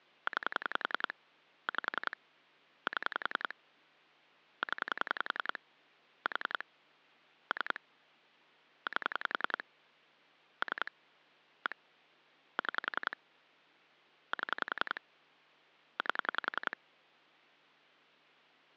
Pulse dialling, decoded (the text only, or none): 9 5 7 0 4 3 8 3 1 6 7 8